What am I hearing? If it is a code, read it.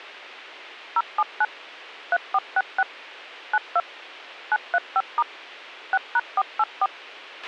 DTMF, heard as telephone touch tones, dialled by machine, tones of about 40 ms, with a squelch burst at the end. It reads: 079 3466 92 935* 6#484